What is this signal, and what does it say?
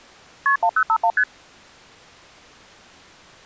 Multi-frequency trunk signalling (R1, as on North American trunks), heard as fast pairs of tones, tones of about 70 ms. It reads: KP 1051 ST